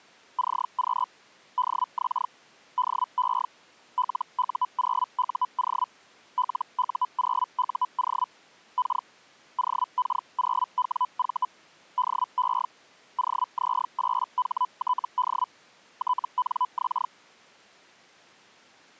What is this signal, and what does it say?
Hellschreiber (Feld-Hell, 122.5 baud), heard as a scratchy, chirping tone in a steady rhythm, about 1000 Hz. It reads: CQ DX DE LU0UO LU0UO K OK0WV DE OZ8HTD TNX